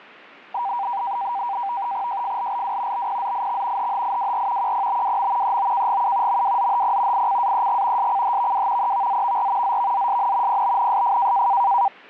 NAVTEX (SITOR-B), 100 baud, 170 Hz shift, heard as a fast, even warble, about 880 Hz centre. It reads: JFLLW BPZIX HHIWR QPBWM EOKGU MWZHP ICAEG SCHVW EVZVR ZVZSN PBNSF